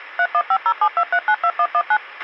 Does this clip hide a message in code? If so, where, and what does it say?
Yes: DTMF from 0.2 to 2.0 s, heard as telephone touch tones, dialled by machine, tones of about 60 ms, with a squelch burst at the end. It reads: 315072392119